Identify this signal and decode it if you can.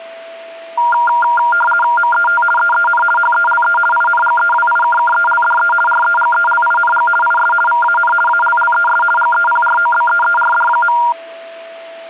RTTY (50 baud, 450 Hz shift), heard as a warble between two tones, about 1180 Hz centre, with a steady whistle near 660 Hz. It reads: MET EEN HELE INGEWIKKELDE REGELING IS VAN ALLES GEPROBEERD.